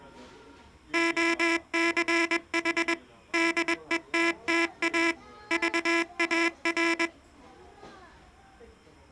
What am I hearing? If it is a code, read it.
Morse code, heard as a buzzer, machine-sent, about 21 wpm, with the noise of a restaurant. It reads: OCH DETTA VAR